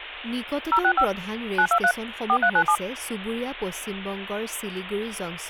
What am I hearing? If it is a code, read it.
DTMF, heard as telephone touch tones, dialled by machine, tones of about 70 ms, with speech in Assamese. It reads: 065 923 4397